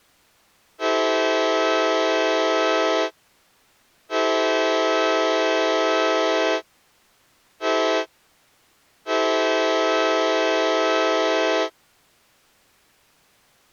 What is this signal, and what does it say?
Train horn signal, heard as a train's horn. 2 long, 1 short, 1 long. On North American railways: approaching a public crossing.